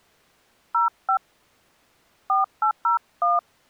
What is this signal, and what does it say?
DTMF, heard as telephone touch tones, dialled by hand, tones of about 130 ms. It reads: 05 4801